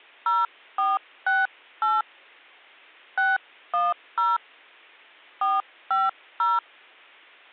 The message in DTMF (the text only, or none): 0468 610 450